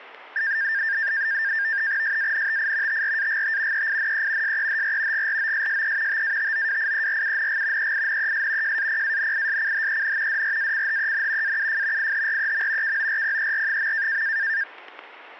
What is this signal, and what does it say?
NAVTEX (SITOR-B), 100 baud, 170 Hz shift, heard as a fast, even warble, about 1700 Hz centre, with static crashes. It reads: SANTI TRAGT EINE SEHR GROSSE TATOWIERUNG EINES JAPANISCHEN DRACHEN AUF IHREM KORPER.